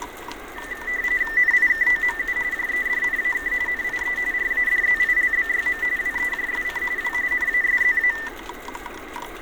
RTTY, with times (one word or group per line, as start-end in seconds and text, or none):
1.4-2.4 NIKOMU
2.5-3.5 JEDNAK
3.7-4.2 NIE
4.3-5.8 RADZILBYM
6.0-6.8 WEJSC
7.0-7.1 W
7.3-8.1 NASZA